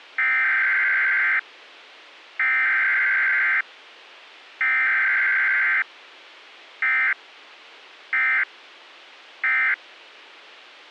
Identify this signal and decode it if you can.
Emergency Alert System (SAME) tones (header bursts, then end-of-message bursts), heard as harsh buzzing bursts, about 520.83 baud.